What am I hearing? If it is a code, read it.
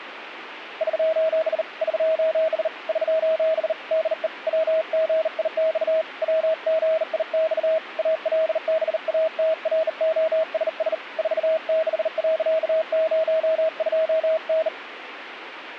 Morse code, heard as a keyed tone, hand-sent with a bug key, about 39 wpm, 640 Hz, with radio static. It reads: <SOS> <SOS> <SOS> DE WGIX WGIX ALBATROSS 46.02N